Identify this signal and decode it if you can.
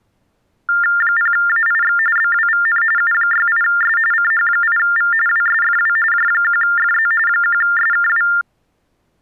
TTY/TDD text telephone tones (45.45 baud Baudot), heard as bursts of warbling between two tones, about 400 Hz shift, 1600 Hz centre. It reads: 0AIX BWVN U68S CH8V WSFW J1FZ 1SKW